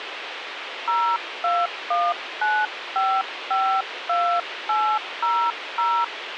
DTMF, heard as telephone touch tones, dialled by hand, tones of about 260 ms, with radio hiss. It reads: 0219552800